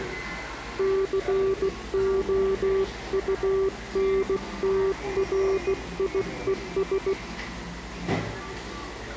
Morse code, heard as a keyed tone, hand-sent with a bug key, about 16 wpm, 390 Hz, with the noise of a cafe. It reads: COUNTRIES